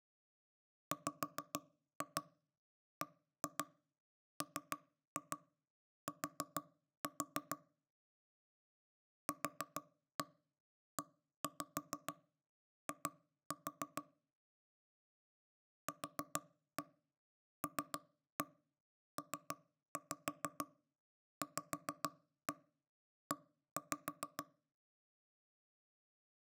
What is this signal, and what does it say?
Tap code, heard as knocks on wood, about 6 knocks a second. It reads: WBMT QEI QLPVE